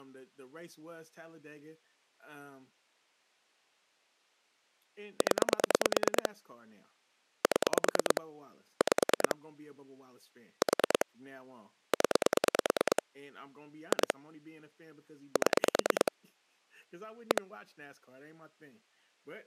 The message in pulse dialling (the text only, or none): 0 7 5 4 0 2 7 1